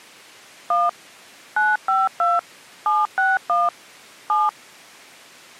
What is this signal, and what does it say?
DTMF, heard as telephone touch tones, dialled by machine, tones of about 190 ms. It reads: 1 952 761 7